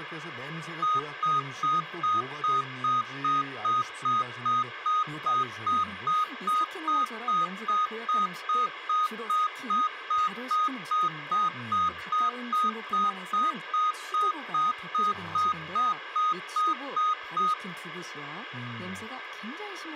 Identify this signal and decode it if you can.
Evenly repeated beeps, with radio hiss and speech in Korean. There is no code.